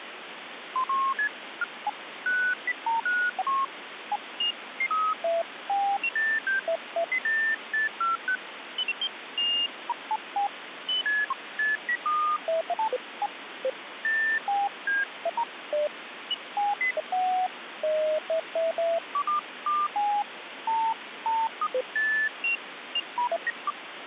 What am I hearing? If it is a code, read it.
Electronic bleeps of random pitch and length, with phone line noise. There is no code.